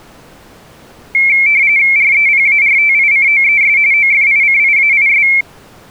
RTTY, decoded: REPARTICOES OFICIAIS

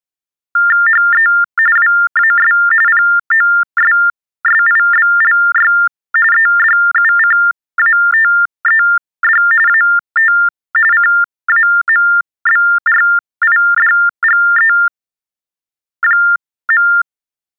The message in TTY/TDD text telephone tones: HE WAS POSSIBLY EDUCATED AT CAMBRIDGE.

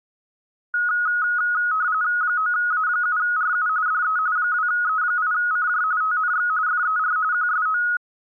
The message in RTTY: 9A7RU DE 2E8CJ TNX FER QSO

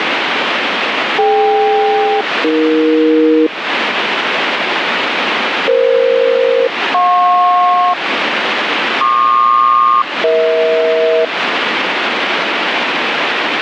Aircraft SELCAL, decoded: DK-AE EF-JP PQ-EH

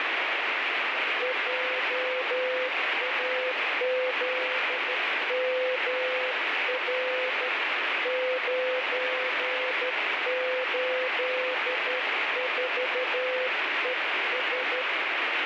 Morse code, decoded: JAZMR 984ES

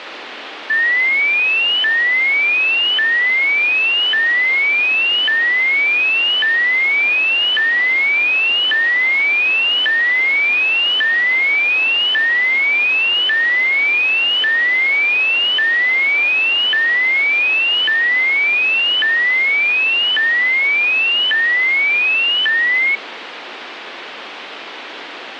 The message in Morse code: none

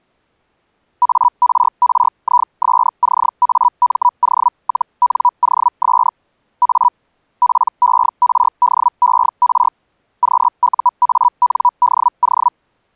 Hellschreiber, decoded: ARRISCAMO-NOS A PERDER QUANDO

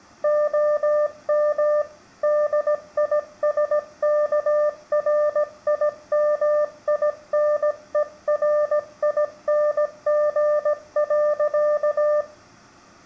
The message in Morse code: OM DISKRIMINERING.

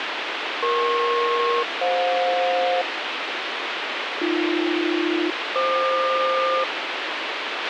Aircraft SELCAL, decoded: EP-FJ AB-FQ

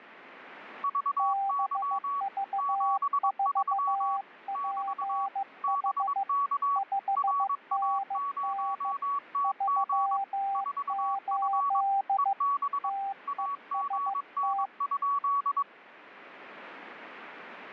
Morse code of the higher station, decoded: VY 73 <BT> BK RA0TG 4F EB AGN?

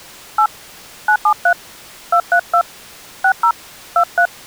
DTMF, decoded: 8 973 232 60 23

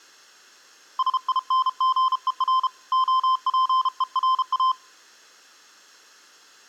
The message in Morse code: SINGER OPERA

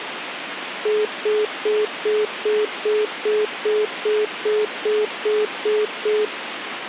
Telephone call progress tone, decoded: congestion tone

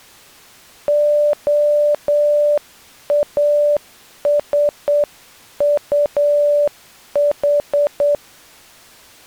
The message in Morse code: OASUH

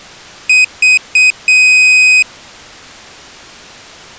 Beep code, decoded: 3 short, 1 long

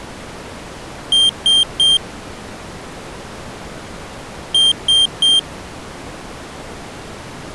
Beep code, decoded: 3 short

